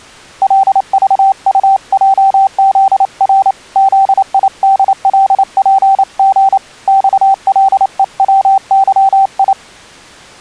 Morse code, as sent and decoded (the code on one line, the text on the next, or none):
.-.. ...- ..- .--- --.. .-. / --.. .. -.. .-.. .--. --. / -..- .-.. . .-- -.-- ..
LVUJZR ZIDLPG XLEWYI